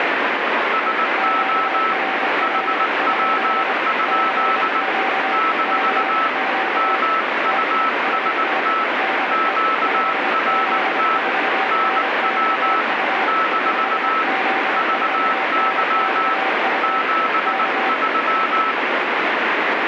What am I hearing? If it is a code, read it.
Morse code, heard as two keyed tones, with heavy radio static. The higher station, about 19 wpm, 1310 Hz: SO HW? - MUST QRT NW - VY 73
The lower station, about 25 wpm, 770 Hz: QRL? CQ CQ TEST DE 5Z4NXU 5Z4NXU K